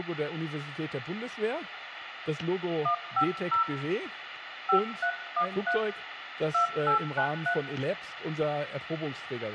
DTMF, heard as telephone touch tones, dialled by hand, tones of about 100 ms, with phone line noise and room echo. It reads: 150 5313 2893